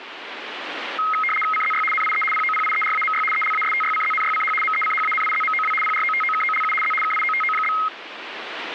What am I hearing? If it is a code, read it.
RTTY (75 baud, 850 Hz shift), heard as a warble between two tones, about 1700 Hz centre, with radio static. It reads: CZY NIE POPIERAMY ELASTYCZNYCH MECHANIZMOW PROTOKOLU Z KIOTO?